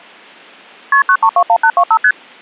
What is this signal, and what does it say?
Multi-frequency trunk signalling (R1, as on North American trunks), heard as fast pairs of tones, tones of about 70 ms. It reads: KP 9321825 ST